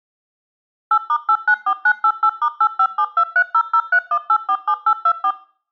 DTMF, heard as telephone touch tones, dialled by machine, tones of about 70 ms. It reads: 8*894988*857230031847824